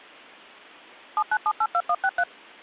DTMF, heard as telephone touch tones, dialled by machine, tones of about 60 ms. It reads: 79782163